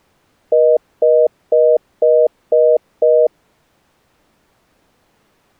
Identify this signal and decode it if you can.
Telephone call progress tone (North American plan), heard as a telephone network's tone, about 480, 620 Hz, 0.25 s on and 0.25 s off. Congestion tone.